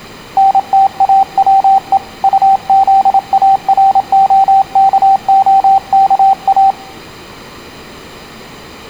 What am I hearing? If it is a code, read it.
Morse code, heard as a keyed tone, hand-sent with a paddle, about 27 wpm, 780 Hz, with room echo. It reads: NTAWE UZAROKOKA